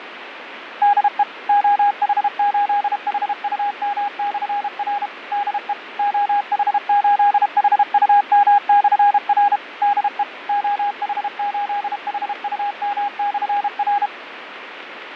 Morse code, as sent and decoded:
-.. . / --- .... ---.. .... ..- -- -..-. .-. / -.. . / --- .... ---.. .... ..- -- -..-. .-. / -.. . / --- .... ---.. .... ..- -- -..-. .-.
DE OH8HUM/R DE OH8HUM/R DE OH8HUM/R

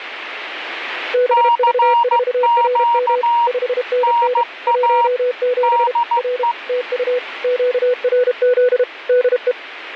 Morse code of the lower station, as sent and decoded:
-... ...- ....- .-. -- / ..... -. -. / .---- --... / .-. / - ..- / --.- .-. --.. / -.. .
BV4RM 5NN 17 R TU QRZ DE

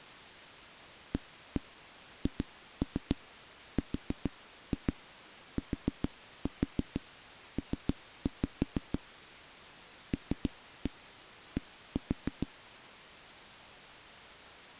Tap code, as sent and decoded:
1-1 2-3 4-2 4-4 3-5 / 3-1 1-4
AHRTP LD

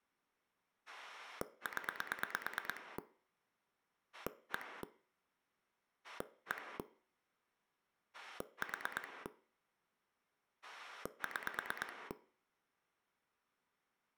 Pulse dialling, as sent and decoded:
10 / 1 / 1 / 4 / 6
0 1 1 4 6

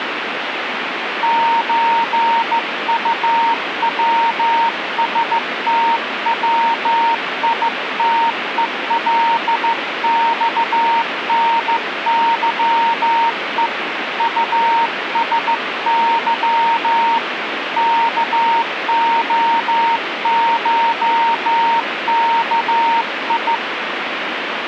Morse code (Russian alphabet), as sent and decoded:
---. ..- .-- ... - .-- .. - . .-.. -..- -. -.-- . / ..- ... -.-- / -.- --- ---- -.- ..
ЧУВСТВИТЕЛЬНЫЕ УСЫ КОШКИ

